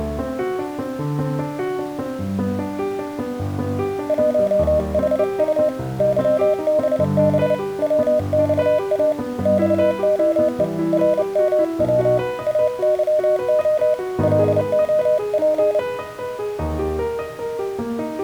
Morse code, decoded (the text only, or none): 1HU YBB WXA XOE RMW AYO LOP